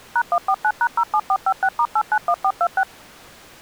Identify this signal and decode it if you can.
DTMF, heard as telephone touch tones, dialled by machine, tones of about 60 ms. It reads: #149#07456*891426